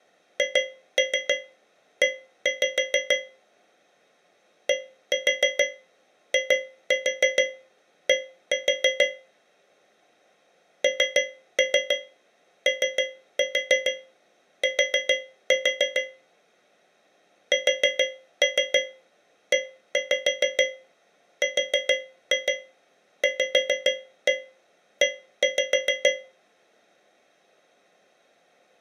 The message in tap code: HE DID NOT SERVE

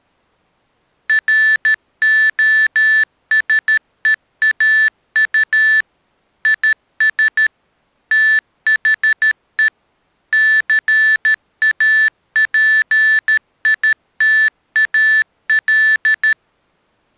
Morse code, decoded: ROSEAU IS THE CAPITAL

